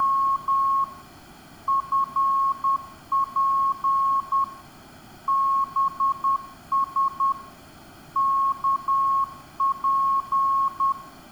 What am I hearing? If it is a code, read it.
Morse code, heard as a keyed tone, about 10 wpm, 1090 Hz, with room echo. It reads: … FP BS KP